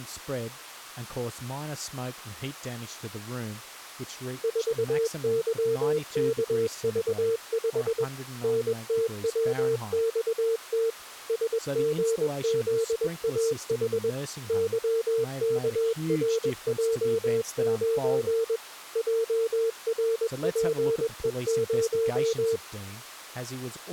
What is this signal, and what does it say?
Morse code, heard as a keyed tone, machine-sent, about 21 wpm, 450 Hz, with speech in English. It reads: 4YKV5 NTWXT SGZAH YKRJ9 JRPE0